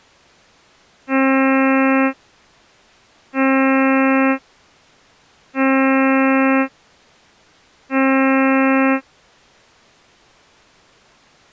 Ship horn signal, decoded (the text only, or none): 4 short